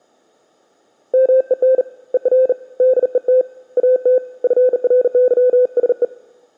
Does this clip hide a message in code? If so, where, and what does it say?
Yes: Morse code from 1.1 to 6.1 s, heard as a keyed tone, hand-sent with a bug key, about 39 wpm, 510 Hz. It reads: MEN ER DET AT FRYSE